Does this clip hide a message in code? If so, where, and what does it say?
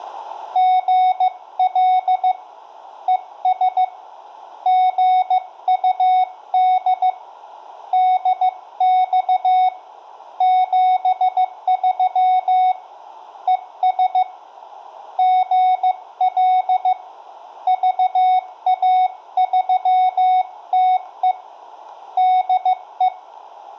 Yes: Morse code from 0.5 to 23.1 s, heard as a keyed tone, hand-sent with a paddle, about 15 wpm, 740 Hz, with room echo. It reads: GL ES GUD DX 73 ES GL VA3TE DE